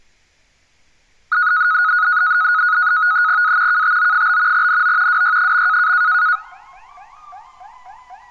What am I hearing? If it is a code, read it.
NAVTEX (SITOR-B), 100 baud, 170 Hz shift, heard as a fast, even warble, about 1360 Hz centre, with street noise. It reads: A KTO? NO WY.